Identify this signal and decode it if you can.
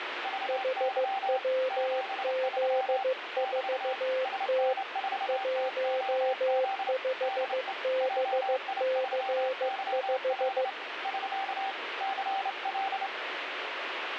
Morse code, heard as two keyed tones, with radio static. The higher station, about 28 wpm, 780 Hz: VY 73 <BT> SN4TOZ DE JI3YL <SK> CL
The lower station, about 15 wpm, 520 Hz: HWZ4T 15BC5